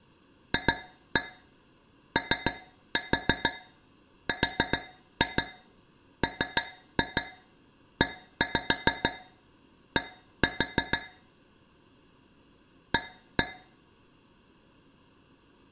Tap code, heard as taps on a metal pipe, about 6 knocks a second, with room echo. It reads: FORMED A